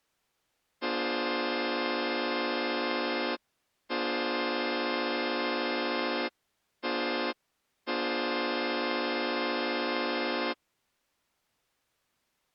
Train horn signal, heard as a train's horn. 2 long, 1 short, 1 long. On North American railways: approaching a public crossing.